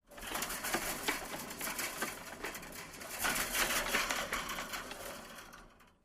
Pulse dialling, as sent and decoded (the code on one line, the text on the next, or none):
none